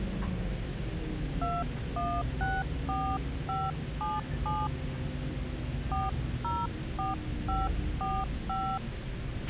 DTMF, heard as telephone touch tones, dialled by hand, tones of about 220 ms, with radio hiss, a squelch burst at the end and the noise inside a bus. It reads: 2164577 404545